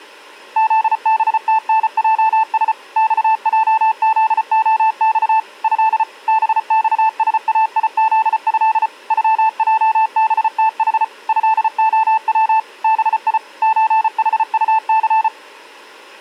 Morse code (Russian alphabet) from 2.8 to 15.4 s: ЬЙЗОЬ Э БЬСАИЗЭ ЮЙБТХ ЭОВ БИ ЧХУЦ

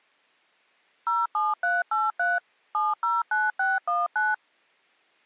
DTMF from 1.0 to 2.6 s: 07383

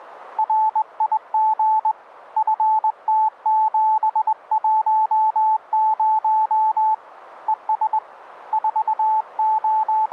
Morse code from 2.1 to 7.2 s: FT710

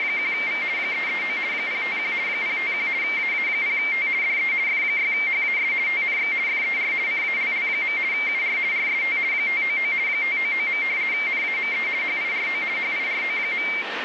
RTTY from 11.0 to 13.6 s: NAME HIRO HIRO.

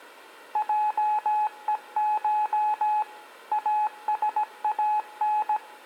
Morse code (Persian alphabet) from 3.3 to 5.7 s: اسان

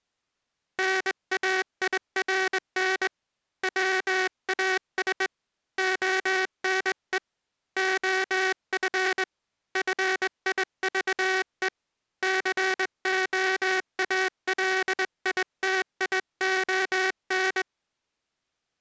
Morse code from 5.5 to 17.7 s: ONE OF FIVE COALITION

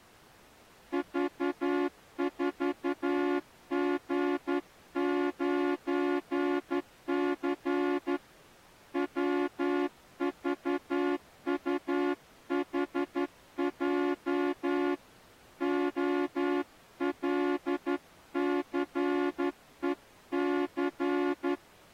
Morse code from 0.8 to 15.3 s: V4G9C WVUHJ

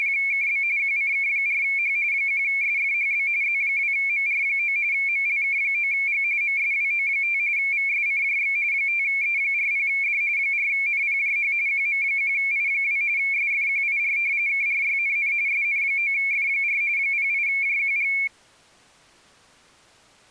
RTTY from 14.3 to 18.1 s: KRYNN SN9F4 08JQG

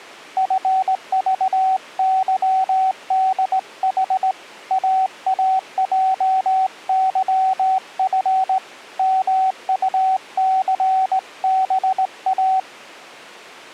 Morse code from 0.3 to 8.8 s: FVYDH AAJYF

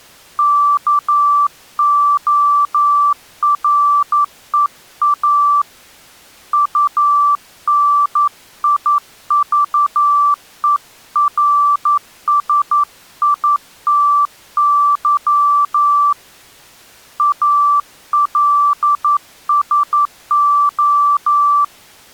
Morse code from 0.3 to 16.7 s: KOREA UNIVERSITY

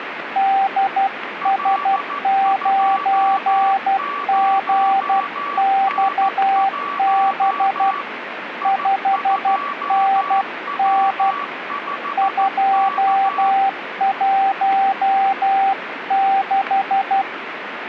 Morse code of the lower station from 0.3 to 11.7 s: DS9GXB 5NN

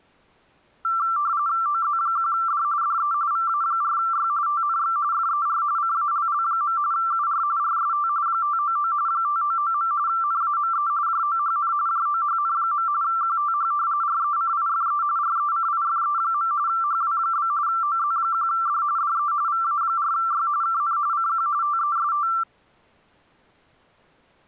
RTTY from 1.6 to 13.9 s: OZ1D DE VA4Y TNX FER CALL. UR RST 599 599. NAME JOHN JOHN. QTH

